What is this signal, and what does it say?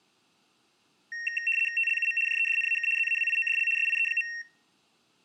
RTTY (75 baud, 850 Hz shift), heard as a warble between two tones, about 2300 Hz centre. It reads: TLUM JEDNAK ZAWIODL SIE.